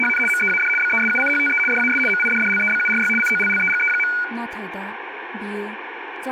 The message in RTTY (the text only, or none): … MEAD BESUCHTE DAS MIDDLEBURY COLLEGE.